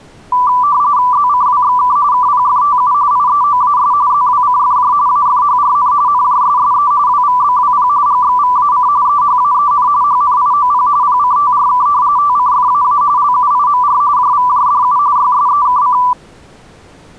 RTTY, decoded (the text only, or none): ZCWXK KPFTU IEOAS ZWCFJ AFHRN NJSSE WVBWP GXVAC EHAEN HNIOP PCTRK TCFAA LUIMR JVJDU YSEKC